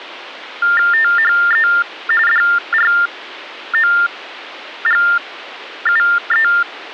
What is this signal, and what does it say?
TTY/TDD text telephone tones (45.45 baud Baudot), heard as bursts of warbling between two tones, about 400 Hz shift, 1600 Hz centre. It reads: THE DROGUE